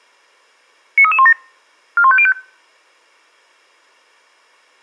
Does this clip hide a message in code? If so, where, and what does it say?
Yes: five-tone selective call (ZVEI) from 1.0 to 2.3 s, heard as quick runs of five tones, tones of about 70 ms. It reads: 93317 41505